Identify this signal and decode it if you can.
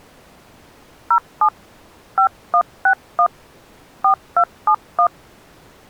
DTMF, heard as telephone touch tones, dialled by hand, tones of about 80 ms. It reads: 07 5161 4271